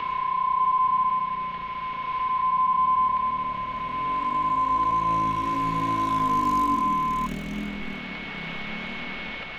PSK31 (31.25 baud), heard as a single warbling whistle, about 1030 Hz, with radio static, a steady whistle near 2200 Hz and street noise.